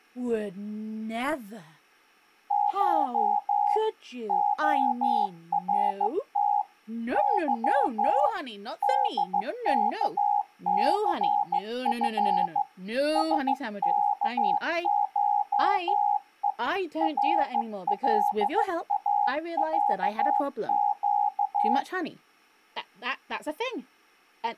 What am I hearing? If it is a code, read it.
Morse code (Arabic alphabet), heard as a keyed tone, hand-sent with a bug key, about 15 wpm, 820 Hz. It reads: ش خرت ظ دكثف سكشء رلاعق